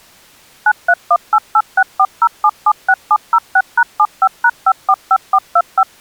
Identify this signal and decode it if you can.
DTMF, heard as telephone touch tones, dialled by machine, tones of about 60 ms. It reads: 93188640776706#75#545425